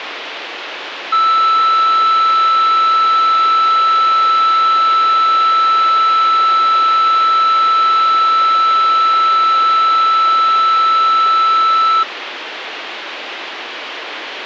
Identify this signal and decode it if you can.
A steady tone, with radio hiss. There is no code.